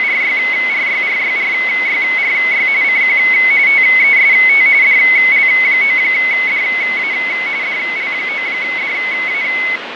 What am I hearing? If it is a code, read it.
RTTY (45.45 baud, 170 Hz shift), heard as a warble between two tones, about 2150 Hz centre, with radio static and fading. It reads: … CQ TEST DL9DA DL9DA